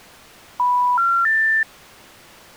Telephone call progress tone (North American plan), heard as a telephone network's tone, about 980, 1370, 1800 Hz. Special information tone.